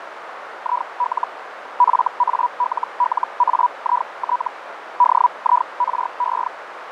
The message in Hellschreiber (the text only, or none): IL FALLAIT DIRE